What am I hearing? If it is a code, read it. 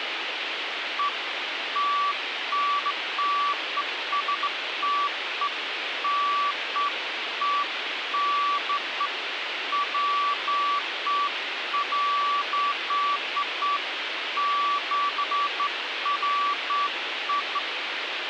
Beeps of irregular length, with radio hiss. There is no code.